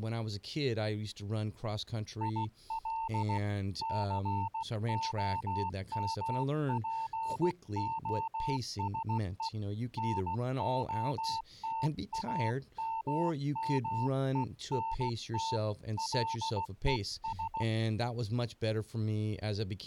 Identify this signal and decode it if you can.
Morse code, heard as a keyed tone, hand-sent with a paddle, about 16 wpm, 900 Hz, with speech in English. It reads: IL COMPOSE NOTAMMENT LES